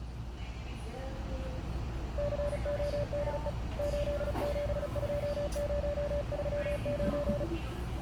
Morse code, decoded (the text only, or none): CODE 872039